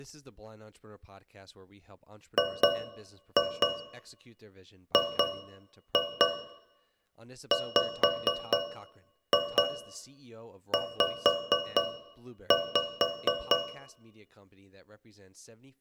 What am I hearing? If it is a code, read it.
Tap code, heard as taps on a metal pipe, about 4 knocks a second, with room echo and speech in English. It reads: GGWZ